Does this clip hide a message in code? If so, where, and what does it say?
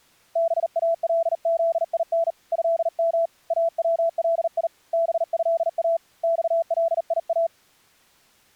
Yes: Morse code (Arabic alphabet) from 0.3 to 7.5 s, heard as a keyed tone, hand-sent with a bug key, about 39 wpm, 670 Hz. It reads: بالذين هم اولي بها صليا